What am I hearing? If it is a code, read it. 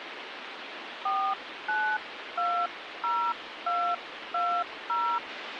DTMF, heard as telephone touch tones, dialled by hand, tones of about 290 ms, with phone line noise. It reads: 4920220